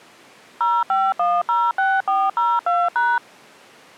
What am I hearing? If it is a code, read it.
DTMF, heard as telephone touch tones, dialled by machine, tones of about 220 ms. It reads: 05106402#